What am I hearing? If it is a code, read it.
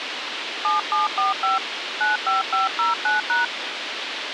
DTMF, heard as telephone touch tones, dialled by hand, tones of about 150 ms, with radio hiss. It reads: 7745 95509#